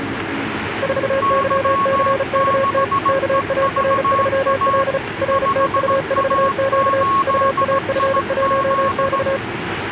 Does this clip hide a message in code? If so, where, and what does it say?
Yes: Morse code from 0.8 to 9.4 s, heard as two keyed tones, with radio static, static crashes and the noise of a subway station. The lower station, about 35 wpm, 540 Hz: 4YCKT KAR3L RTU4Q UAF1X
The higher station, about 17 wpm, 1100 Hz: Y6EVA 5A8IZ